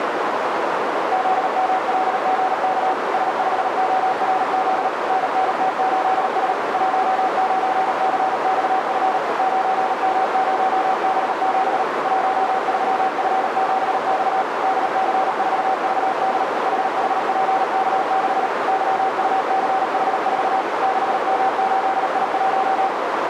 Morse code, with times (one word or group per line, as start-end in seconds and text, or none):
1.1-2.9 ZMLGK
3.1-4.9 S5ORZ
5.1-6.5 NNT8S
6.7-9.2 19CXF
9.4-11.8 9M0B7
12.0-14.4 13F7X
14.6-16.4 DC4VD
16.7-18.5 HHPK6
18.7-20.6 YUCH4
20.8-22.9 6M8I1